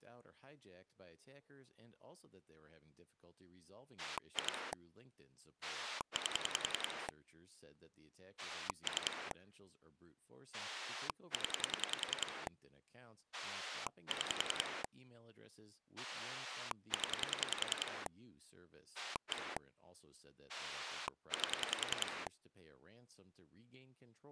Pulse dialling, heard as a rotary dial, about 10 pulses a second, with speech in English. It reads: 2 8 3 0 6 0 1 8